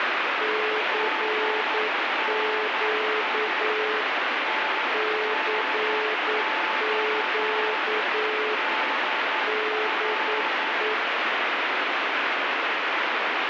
Morse code, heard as two keyed tones, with heavy radio static. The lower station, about 9 wpm, 430 Hz: CQ CQ DE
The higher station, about 10 wpm, 870 Hz: MNI TNX DR